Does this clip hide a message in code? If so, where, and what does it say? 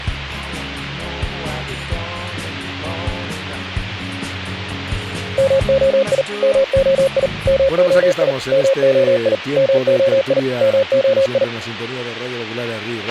Yes: Morse code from 5.3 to 11.5 s, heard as a keyed tone, machine-sent, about 39 wpm, 540 Hz, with a squelch burst at the end. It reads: MOI MOI MOI MOI MOI MOI